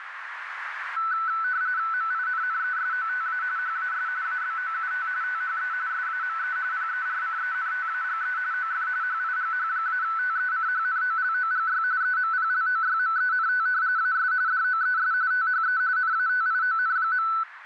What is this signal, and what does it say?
RTTY (45.45 baud, 170 Hz shift), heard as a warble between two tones, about 1410 Hz centre, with radio static and a narrow filter. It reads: MINNESOTA HAS ABOUT THE SAME PERCENTAGE OF HIGH-TECHNOLOGY EMPLOYMENT AS DOES THE NATION.